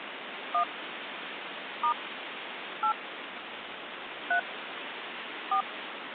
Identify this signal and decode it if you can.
DTMF, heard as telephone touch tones, dialled by hand, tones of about 90 ms, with phone line noise. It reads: 1 * 8 3 4